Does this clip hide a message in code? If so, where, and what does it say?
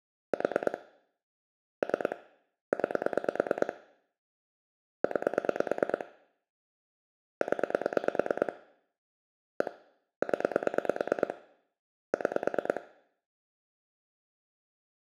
Yes: pulse dialling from 0.3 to 12.8 s, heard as clicks on a phone line, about 9 pulses a second, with room echo. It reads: 4 3 9 9 0 1 0 6